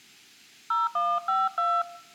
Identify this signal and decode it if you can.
DTMF, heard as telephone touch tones, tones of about 210 ms. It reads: 0152